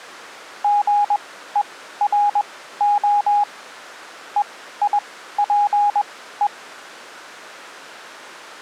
Morse code (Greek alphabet), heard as a keyed tone, machine-sent, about 21 wpm, spaced as for 14 wpm, 820 Hz. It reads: ΓΕΡΟ ΕΙΠΕ